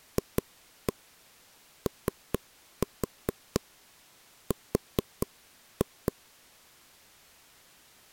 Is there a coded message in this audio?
Yes: tap code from 0.2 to 6.1 s, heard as taps on a table, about 4 knocks a second. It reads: FOR